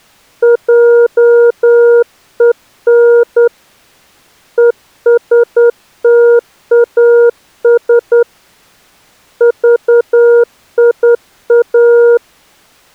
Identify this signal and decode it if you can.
Morse code, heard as a keyed tone, hand-sent with a straight key, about 10 wpm, 470 Hz. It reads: JEN ESTAS VIA